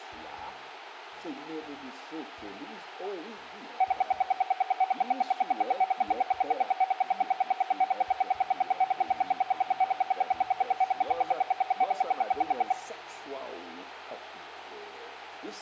Radio time signal (RWM, Moscow), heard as ten pulses a second, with radio static.